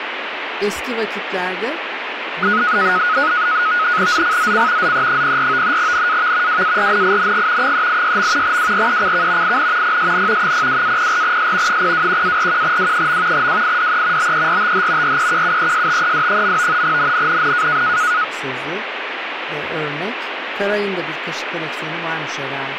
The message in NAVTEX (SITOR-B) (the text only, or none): ZCZC ZE04 NAV WARNING 386. WRECK IN PSN 02-04S 021-41W. WIDE BERTH REQUESTED. NNNN